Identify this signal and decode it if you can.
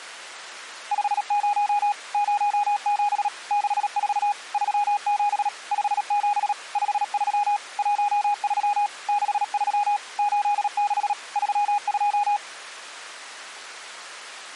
Morse code, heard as a keyed tone, machine-sent, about 37 wpm, 820 Hz. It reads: 50 07 64 37 57 53 13 63 86 32